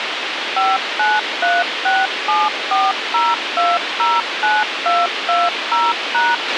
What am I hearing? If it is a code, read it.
DTMF, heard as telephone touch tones, dialled by machine, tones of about 200 ms, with radio hiss and a squelch burst at the end. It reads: 5936740209220#